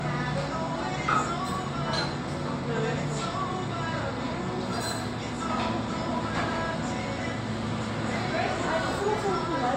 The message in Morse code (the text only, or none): none